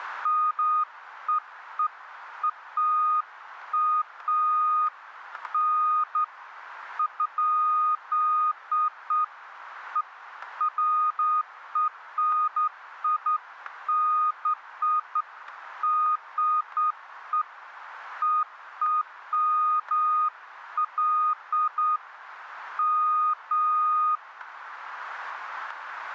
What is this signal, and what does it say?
Beeps of irregular length, with static crashes. There is no code.